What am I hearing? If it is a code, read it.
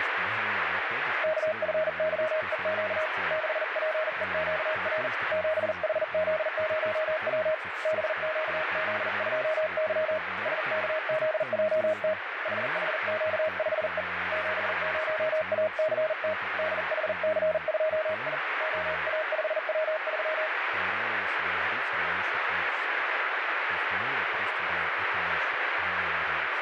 Morse code, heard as a keyed tone, hand-sent with a paddle, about 40 wpm, 630 Hz, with heavy radio static and speech in Russian. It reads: KFYEQ 6PEQR 7HZ0W BQZ2Y SKZJT HHQ5E 70ACT DHC2I OA5W3